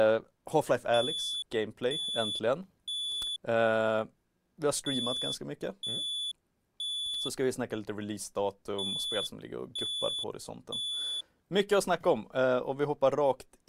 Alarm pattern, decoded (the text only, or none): temporal three